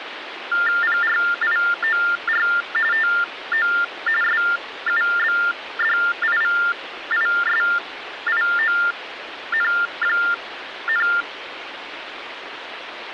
TTY/TDD text telephone tones (45.45 baud Baudot), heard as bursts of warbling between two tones, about 400 Hz shift, 1600 Hz centre, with phone line noise. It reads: PRIOR TO SUBDIVISION,